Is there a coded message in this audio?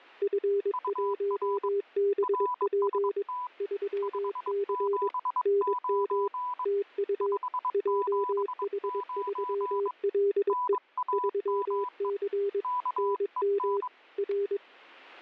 Yes: Morse code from 0.2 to 14.6 s, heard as two keyed tones, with static crashes. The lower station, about 22 wpm, 400 Hz: F1BP 3C NM TU JH3LE 3C NM R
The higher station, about 22 wpm, 990 Hz: UR RST 579 579 NAME KEN